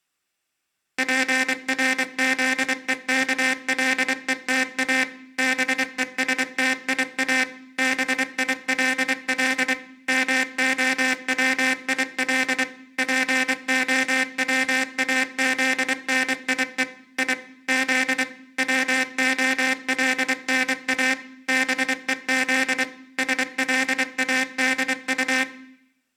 Morse code, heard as a buzzer, machine-sent, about 24 wpm, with room echo. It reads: PRZEKLETA BESTIA BILL MOWIL POWAZNIE I Z WOLNA BEZ SLADU